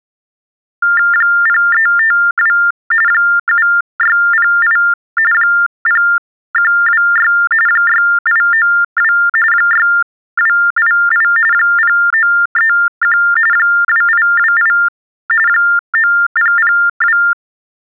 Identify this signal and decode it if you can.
TTY/TDD text telephone tones (45.45 baud Baudot), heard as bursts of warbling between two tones, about 400 Hz shift, 1600 Hz centre. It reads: 0352 7608 0126 6892 6288 0931 2828 9002